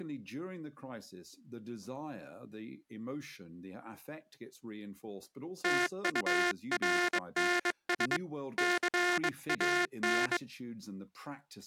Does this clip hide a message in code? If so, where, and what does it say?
Yes: Morse code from 5.6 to 10.4 s, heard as a buzzer, hand-sent with a bug key, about 22 wpm, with speech in English. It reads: TURNS CAN